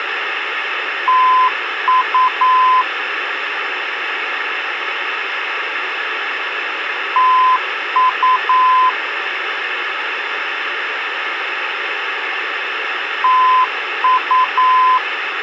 Morse code, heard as a keyed tone, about 9 wpm, 1020 Hz, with radio hiss. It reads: TU TU TU